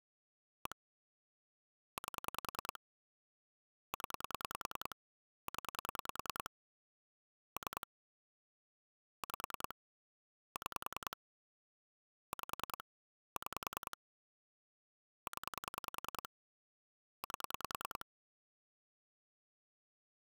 Pulse dialling, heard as clicks on a phone line, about 10 pulses a second. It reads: 1 8 0 0 3 5 6 5 6 0 8